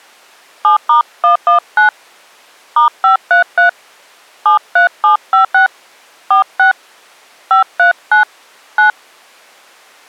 DTMF, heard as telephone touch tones, dialled by hand, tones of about 120 ms. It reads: 7*119 *533 73756 46 539 9